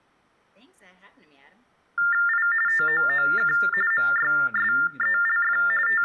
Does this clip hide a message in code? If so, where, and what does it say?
Yes: TTY/TDD text telephone tones (45.45 baud Baudot) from 2.0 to 6.0 s, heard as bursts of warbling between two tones, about 400 Hz shift, 1600 Hz centre, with speech in English. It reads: I TOOK MYSELF …